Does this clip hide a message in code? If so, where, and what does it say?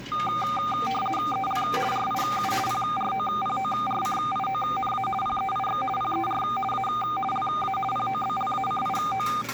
Yes: RTTY (50 baud, 450 Hz shift) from 0.1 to 9.4 s, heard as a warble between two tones, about 1000 Hz centre, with static crashes and the noise of a cafe. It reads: EL RIU PROPORCIONA PEIX PER A LA POBLACIO